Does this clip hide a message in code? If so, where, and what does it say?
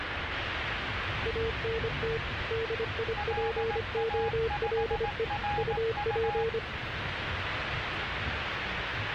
Yes: Morse code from 1.2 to 6.6 s, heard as two keyed tones, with radio static and the noise inside a bus. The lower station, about 25 wpm, 450 Hz: ANT DIPOLE UP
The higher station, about 18 wpm, 830 Hz: LA5RU